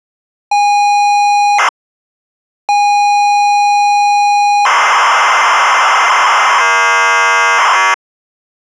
ZX Spectrum tape loading, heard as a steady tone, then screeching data.